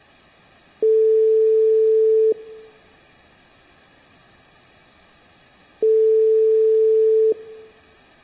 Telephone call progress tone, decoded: ringback tone

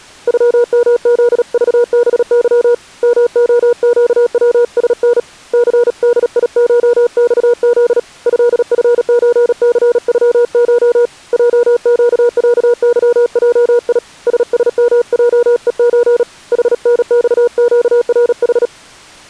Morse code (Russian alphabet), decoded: ЮМЗЖБЫ МОЩВСН ЦДИШЬЗ ЭФЧЦЮШ ЙЩЯЫЙИ ССМЙЕЧ ХНЬЩРХ

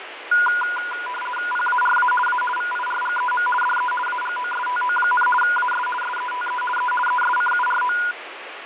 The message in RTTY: PARA A VIRGEM DE AGOSTO, AS SETE E ESCURO

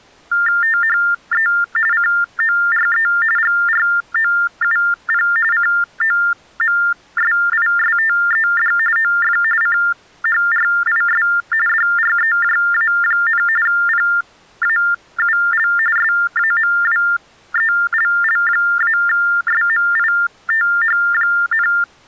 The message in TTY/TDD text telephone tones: THE CORE GROUP COMSISTED OF CHRIS DREJA, PAUL SAMWELL-SMITH,

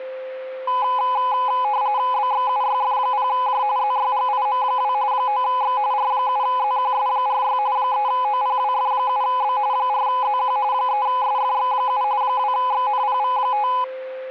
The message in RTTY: BXUYF0J ZYGIM2 9X R7ZQS46 3OPWF7B 4ZQ 3SFX7 2XNPV5

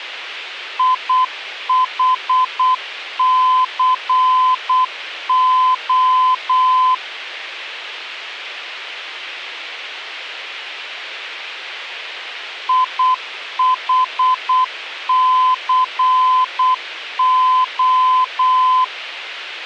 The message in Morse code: IHCO IHCO

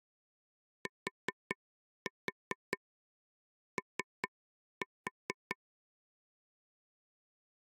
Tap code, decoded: TO

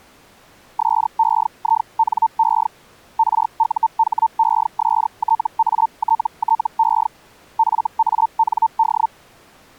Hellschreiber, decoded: SEINE RUHESTATTE FAND

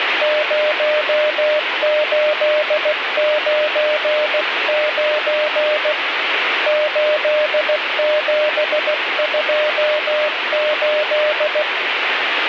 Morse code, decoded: 0899 8728

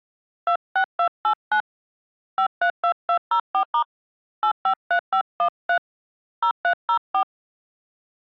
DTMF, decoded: 26289 532204* 853513 0304

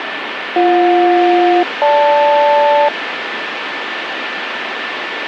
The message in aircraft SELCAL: BJ-GL

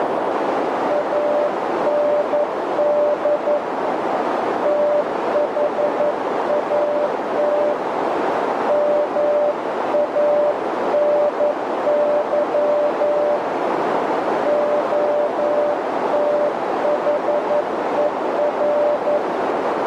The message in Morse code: AND THAT MANY OTHER

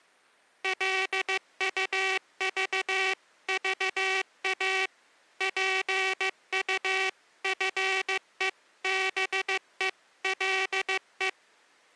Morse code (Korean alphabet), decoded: 길로 지나다가

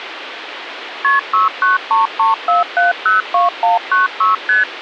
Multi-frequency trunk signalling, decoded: KP 69334702196 ST

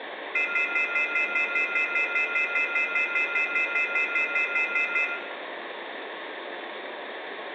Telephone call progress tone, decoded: off-hook warning tone

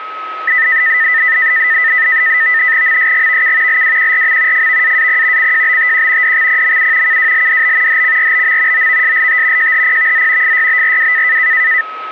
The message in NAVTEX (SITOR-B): MSGVK LWQRM FVAAP CJBTQ DXPMU KWLDB HCRBM OVSLT JHPVZ FYBRW

